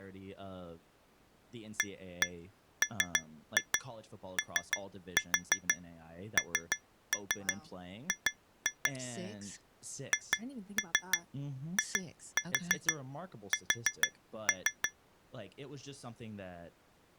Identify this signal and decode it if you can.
Tap code, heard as taps on glass, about 6 knocks a second, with speech in English. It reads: AMONG HIS